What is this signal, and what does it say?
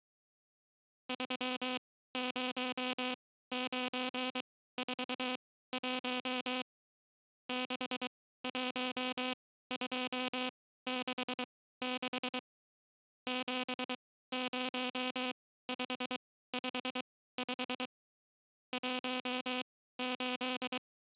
Morse code, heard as a buzzer, machine-sent, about 23 wpm, spaced as for 15 wpm. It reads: 30941 61266 70555 …